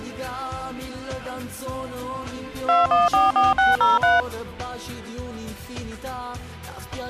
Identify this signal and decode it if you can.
DTMF, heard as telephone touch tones, dialled by machine, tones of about 170 ms. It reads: 2144603